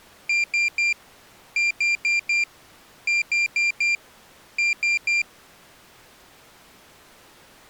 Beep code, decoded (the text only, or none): 3-4-4-3